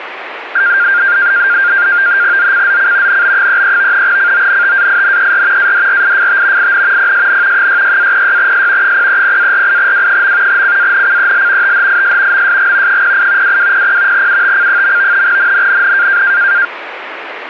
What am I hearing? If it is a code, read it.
NAVTEX (SITOR-B), 100 baud, 170 Hz shift, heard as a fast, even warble, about 1500 Hz centre, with radio static. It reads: ZCZC NB33 CONTAINER ADRIFT IN PSN 66-06S 030-48W. CANCEL THIS MSG 08 2200 UTC. NNNN